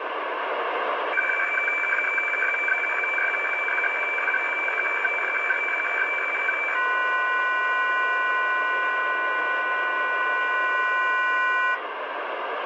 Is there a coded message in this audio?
Yes: weather fax (radiofax), 120 lines a minute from 1.1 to 11.7 s, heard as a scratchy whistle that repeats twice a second, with radio static.